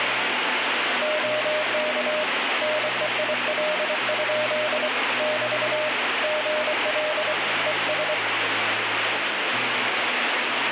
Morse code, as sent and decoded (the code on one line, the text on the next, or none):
--- -.- / -. . .. .-.. ..--.. / -...- / --. .-.. / . ...
OK NEIL? <BT> GL ES